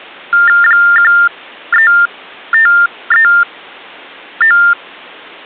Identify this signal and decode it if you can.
TTY/TDD text telephone tones (45.45 baud Baudot), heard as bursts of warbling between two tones, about 400 Hz shift, 1600 Hz centre. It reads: 13539